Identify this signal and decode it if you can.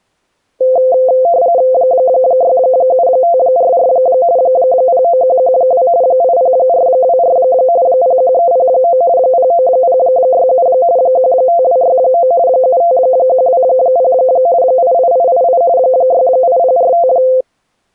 RTTY (45.45 baud, 170 Hz shift), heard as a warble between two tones, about 600 Hz centre. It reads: 67544 09112 80424 01309 09067 15269 75120 88888 68045